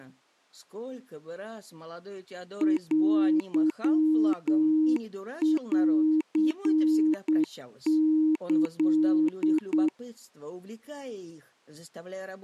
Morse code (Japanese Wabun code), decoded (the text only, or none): テンキ